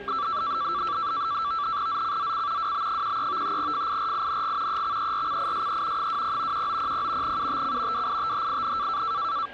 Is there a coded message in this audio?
Yes: NAVTEX (SITOR-B), 100 baud, 170 Hz shift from 0.1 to 9.5 s, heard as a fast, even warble, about 1240 Hz centre, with static crashes, a steady whistle near 1620 Hz and the noise of a subway station. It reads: ZCZC WB13 FIRING EXERCISE 20 1900 UTC WITHIN